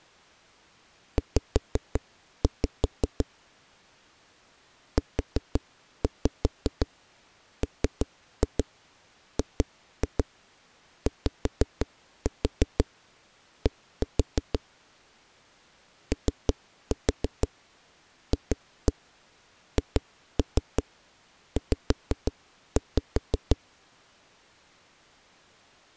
Tap code, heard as knocks on a wall, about 5 knocks a second. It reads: Z UMGYD OFHZ